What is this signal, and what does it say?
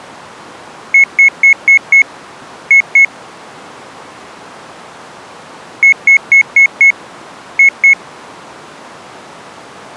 Beep code, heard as beeps, played twice, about 2200 Hz. 5-2.